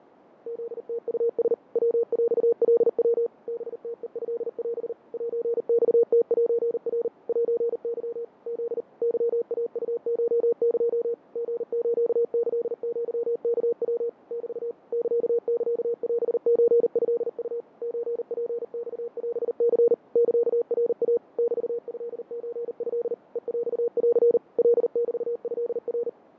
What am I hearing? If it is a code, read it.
Morse code (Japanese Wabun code), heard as a keyed tone, machine-sent, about 39 wpm, 470 Hz, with radio static and fading. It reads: フムウラ ヤヰカヤ ハムヘトオ セマムセナ セケ フ ケイウコエ リスキアワヤ メ ササオソトウ ソツマオニ サナイ メトソト ヘヰン カメトナ